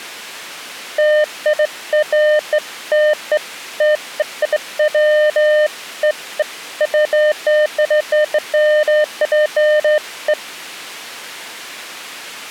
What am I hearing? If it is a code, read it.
Beeps of irregular length. There is no code.